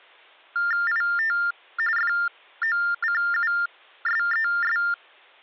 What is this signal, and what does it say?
TTY/TDD text telephone tones (45.45 baud Baudot), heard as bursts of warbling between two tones, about 400 Hz shift, 1600 Hz centre. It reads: IT FOCUSES